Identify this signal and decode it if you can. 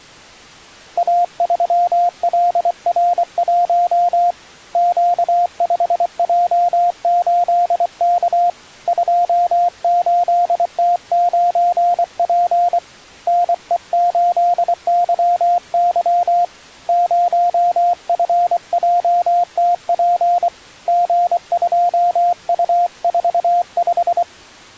Morse code, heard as a keyed tone, hand-sent with a paddle, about 24 wpm, 700 Hz. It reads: A3LR1 Q5J8K 28T9P NE8YY 0FJTP G2U45